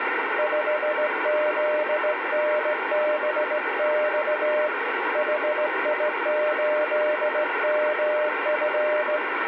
Morse code, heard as a keyed tone, hand-sent with a straight key, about 17 wpm, 600 Hz, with radio static. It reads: 5ZNBX HI8MF